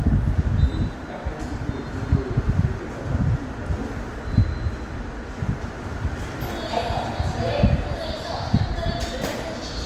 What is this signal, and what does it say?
The noise of a subway station. There is no code.